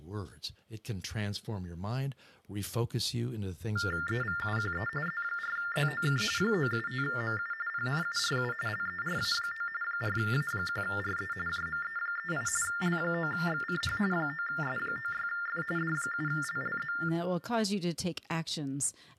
TTY/TDD text telephone tones (45.45 baud Baudot), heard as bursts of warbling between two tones, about 400 Hz shift, 1600 Hz centre, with room echo and speech in English. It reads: EVUQE Z4ZOK 975MU PNURU LERA9 4A1RE JME38 L9XCH 9S96F D7LLZ